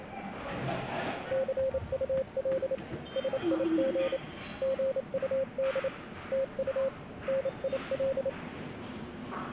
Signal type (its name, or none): Morse code